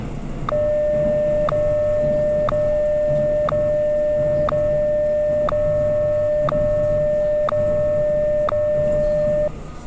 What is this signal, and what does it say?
Radio time signal (WWVH, Hawaii), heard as ticks, one a second, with the noise inside a subway train.